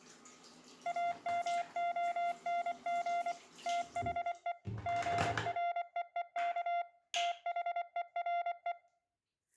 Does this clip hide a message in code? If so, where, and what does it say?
Yes: Morse code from 0.8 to 8.8 s, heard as a keyed tone, machine-sent, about 24 wpm, 690 Hz, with room echo and the noise of a restroom. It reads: AMONG THE GREEK THERE